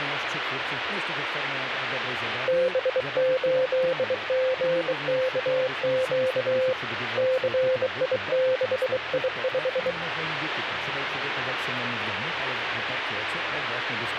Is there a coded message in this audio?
Yes: Morse code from 2.4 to 10.0 s, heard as a keyed tone, hand-sent with a bug key, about 23 wpm, 520 Hz, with radio static. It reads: B8GKQ CI6I5